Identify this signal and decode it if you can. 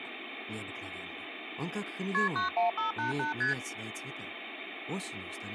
Multi-frequency trunk signalling (R1, as on North American trunks), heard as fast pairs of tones, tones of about 130 ms, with phone line noise. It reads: KP 91588 ST